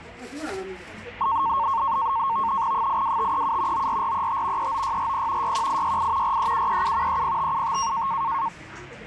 NAVTEX (SITOR-B), 100 baud, 170 Hz shift, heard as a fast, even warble, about 1000 Hz centre, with the noise of a crowd indoors. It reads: 82537 94435 39640 61868 43737 30575